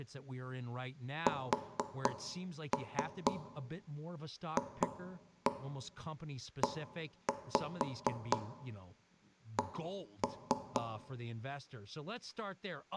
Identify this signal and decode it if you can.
Tap code, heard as knocks on wood, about 4 knocks a second, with room echo and speech in English. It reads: SFEC